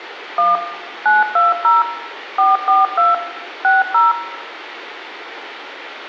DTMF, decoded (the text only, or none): 1 920 442 60